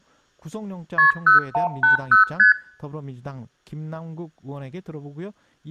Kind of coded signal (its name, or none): multi-frequency trunk signalling